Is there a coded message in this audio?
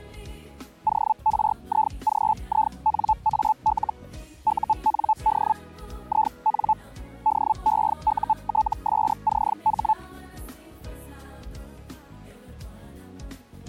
Yes: Hellschreiber (Feld-Hell, 122.5 baud) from 0.9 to 9.9 s, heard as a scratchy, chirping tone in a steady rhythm, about 870 Hz. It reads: ORIGINAL UND IN DEUTSCH